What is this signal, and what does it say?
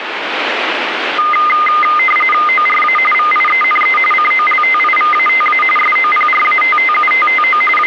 RTTY (45.45 baud, 850 Hz shift), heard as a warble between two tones, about 1650 Hz centre, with radio static. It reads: ORA VIENE COLTIVATA SOPRATTUTTO …